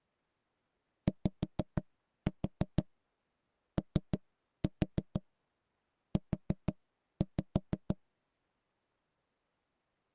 Tap code, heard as knocks on wood, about 6 knocks a second. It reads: YOU